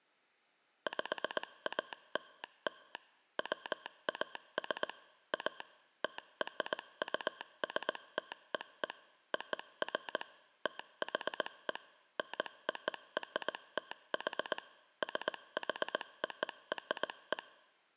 Morse code (American railroad code), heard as a telegraph sounder, machine-sent. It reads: PALL WAS A TRUSTEE OF THE NORTH SHORE